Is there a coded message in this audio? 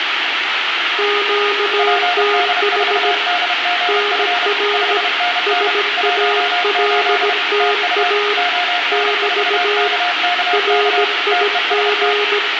Yes: Morse code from 0.9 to 12.4 s, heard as two keyed tones, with radio static and room echo. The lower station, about 17 wpm, 410 Hz: QTH NR SALTA <BT> RIG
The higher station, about 31 wpm, 710 Hz: PD4DGF 5NN 18 TU ON4KKK TEST